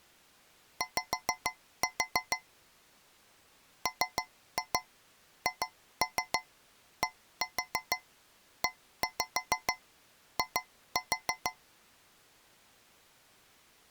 Tap code, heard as taps on a metal pipe, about 6 knocks a second. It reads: Y MHDEI